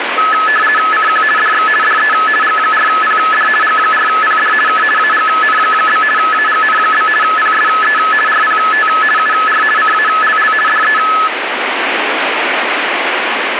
RTTY (50 baud, 450 Hz shift), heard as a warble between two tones, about 1500 Hz centre, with radio static. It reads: CQ DX DE G4PD G4PD K AGN? AGN? PSE RPT UR CALL DE